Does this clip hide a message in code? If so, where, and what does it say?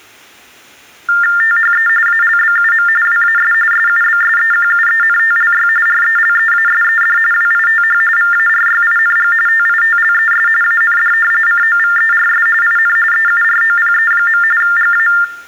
Yes: TTY/TDD text telephone tones (45.45 baud Baudot) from 1.1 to 15.2 s, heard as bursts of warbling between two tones, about 400 Hz shift, 1600 Hz centre. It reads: THE ALBUM WAS SUBSEQUENTLY RELEASED WITH VARYING TITLES AND COVERS IN EUROPE. GA